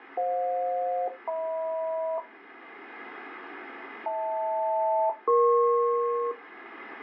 Aircraft SELCAL, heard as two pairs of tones, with radio static. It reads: FJ-HM HL-EP